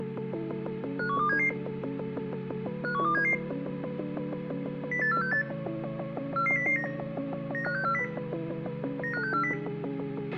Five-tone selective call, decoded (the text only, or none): 51277 51277 08468 44009 95640 95640